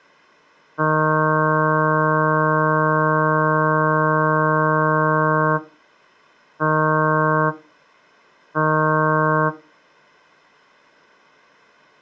Ship horn signal, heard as a ship's horn, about 160 Hz. 1 long, 2 short. At sea: a vessel in fog that is sailing, fishing, towing or hampered.